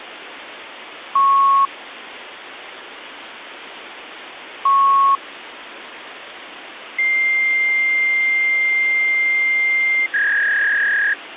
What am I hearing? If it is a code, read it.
Fax machine handshake, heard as beeps, a long tone and a warble, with phone line noise.